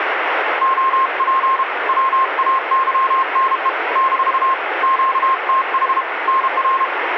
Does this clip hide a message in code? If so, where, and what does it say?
Yes: Morse code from 0.6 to 6.9 s, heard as a keyed tone, hand-sent with a paddle, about 32 wpm, 1060 Hz, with radio static and room echo. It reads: OP WAYNE - QTH NR